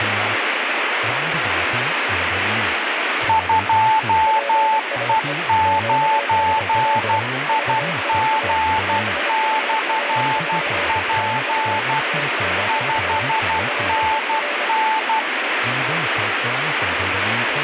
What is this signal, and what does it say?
Morse code, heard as two keyed tones, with radio static and speech in German. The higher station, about 12 wpm, 880 Hz: 2E9IG/P 5NN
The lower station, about 26 wpm, 580 Hz: PSE QSL VIA BURO <BT> TNX FER